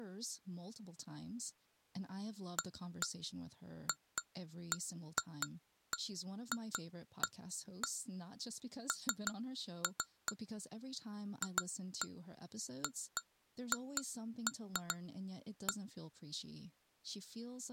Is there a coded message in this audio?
No, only irregular taps on glass.